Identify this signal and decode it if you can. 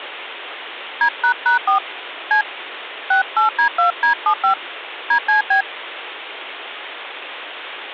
DTMF, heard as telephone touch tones, dialled by hand, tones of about 100 ms, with phone line noise. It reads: D##4 C 68D2D75 DCB